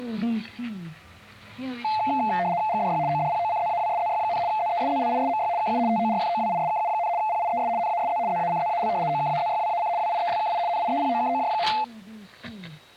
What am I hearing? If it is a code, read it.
RTTY (75 baud, 170 Hz shift), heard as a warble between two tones, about 780 Hz centre. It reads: GDY ODPOCZAWSZY, ZESZLISMY KU TORFOWISKU, PIES NASZ ZACZAL OKAZYWAC WIELKI NIEPOKOJ.